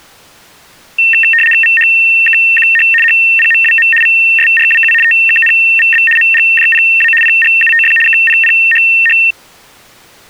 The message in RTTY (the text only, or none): VHKQH HPMWM VSRWU TKNVB MGJPA PGUTF KPPHH